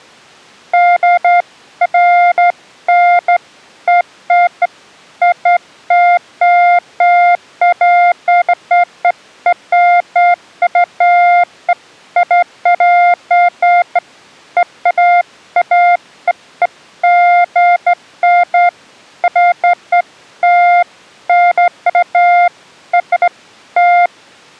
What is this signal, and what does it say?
Beeps of irregular length. There is no code.